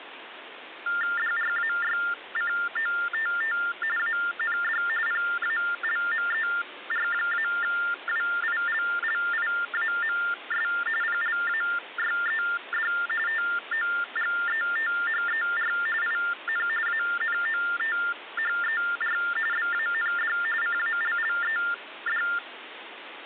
TTY/TDD text telephone tones (45.45 baud Baudot), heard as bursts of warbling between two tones, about 400 Hz shift, 1600 Hz centre, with phone line noise. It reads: DRAYCOTT AND PALMER-WILLIAMS PLAYED TOGETHER IN ANOTHER BAND CALLED